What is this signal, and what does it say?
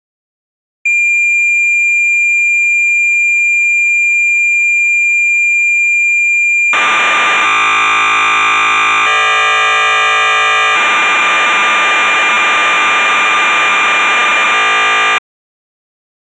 Cassette data (Kansas City type), 1200 baud, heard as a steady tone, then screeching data.